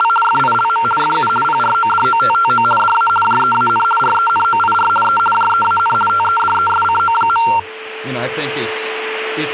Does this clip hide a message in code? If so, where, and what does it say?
Yes: RTTY (50 baud, 450 Hz shift) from 0.0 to 7.6 s, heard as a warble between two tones, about 1140 Hz centre, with radio static, a steady whistle near 440 Hz and speech in English. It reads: … FILM FU PRODOTTO DA JEAN RENOIR E JEAN TEDESCO.